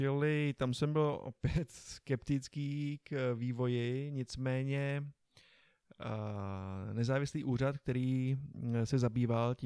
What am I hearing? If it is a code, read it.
Speech in Czech. There is no code.